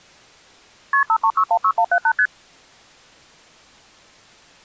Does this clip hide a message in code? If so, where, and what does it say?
Yes: multi-frequency trunk signalling (R1, as on North American trunks) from 0.9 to 2.3 s, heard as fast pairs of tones, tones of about 70 ms. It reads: KP 53616178 ST